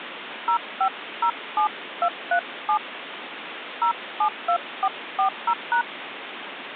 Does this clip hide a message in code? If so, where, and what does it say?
Yes: DTMF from 0.5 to 5.8 s, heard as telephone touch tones, dialled by hand, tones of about 80 ms, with phone line noise. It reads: 0507237 072440#